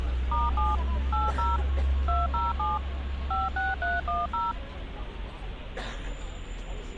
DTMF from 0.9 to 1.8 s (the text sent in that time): 80